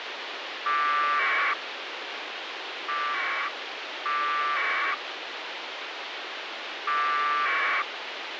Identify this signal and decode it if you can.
Packet radio (AX.25, as in APRS), 1200 baud, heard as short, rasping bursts, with radio hiss.